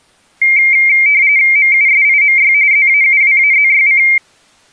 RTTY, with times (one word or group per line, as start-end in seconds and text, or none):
1.6-2.5 MUSIMY
2.7-4.0 ZAUWAZYC